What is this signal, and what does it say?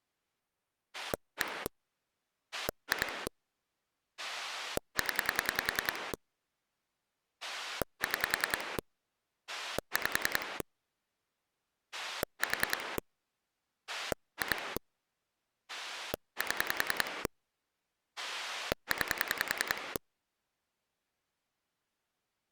Pulse dialling, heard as a rotary dial, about 10 pulses a second. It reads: 1 2 0 6 5 4 2 7 9